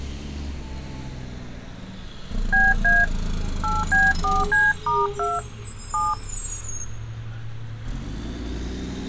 DTMF, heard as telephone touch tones, dialled by hand, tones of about 200 ms, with street noise. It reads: BA 8B4C*2 7